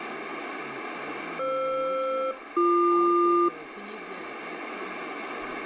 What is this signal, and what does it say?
Aircraft SELCAL, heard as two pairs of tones, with radio static. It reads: FR-BQ